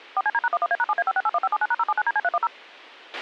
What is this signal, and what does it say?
DTMF, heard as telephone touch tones, dialled by machine, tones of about 40 ms, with a squelch burst at the end. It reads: 4CD#11A#7A5681579#079DC310